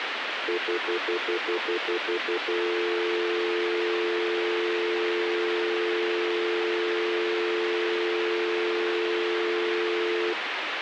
Telephone call progress tone (North American plan), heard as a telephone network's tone, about 350, 440 Hz, 0.1 s on and 0.1 s off, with phone line noise. Stutter dial tone.